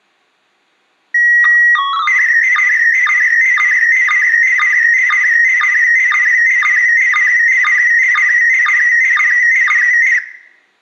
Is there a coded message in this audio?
Yes: SSTV (slow-scan television), PD 120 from 1.1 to 10.2 s, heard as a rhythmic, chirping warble, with room echo.